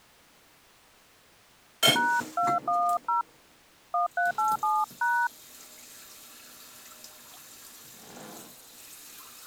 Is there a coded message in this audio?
Yes: DTMF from 2.0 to 5.3 s, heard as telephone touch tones, dialled by hand, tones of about 210 ms, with kitchen noise. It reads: #210 1387#